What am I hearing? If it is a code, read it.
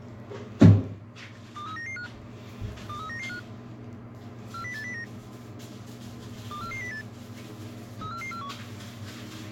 Five-tone selective call (CCIR), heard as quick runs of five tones, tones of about 100 ms, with the noise of a restroom. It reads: 23995 23995 40809 24408 34441